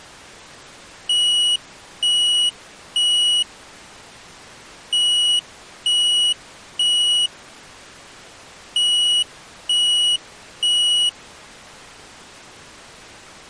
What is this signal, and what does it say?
Alarm pattern, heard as an alarm's beeps, played three times, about 2900 Hz. Temporal three. Smoke or fire, evacuate.